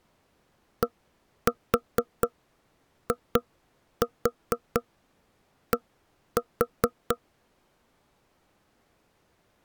Tap code, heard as knocks on wood, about 4 knocks a second. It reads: DID